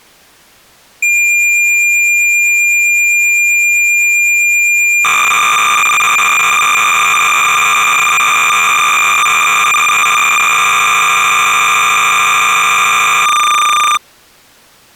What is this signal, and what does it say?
Cassette data (Kansas City type), 300 baud, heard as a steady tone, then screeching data.